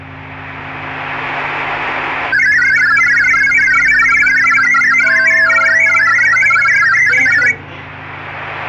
Multi-tone FSK (Olivia or MFSK type), about 1000 Hz wide, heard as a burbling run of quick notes, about 62.5 baud, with the noise inside a lift.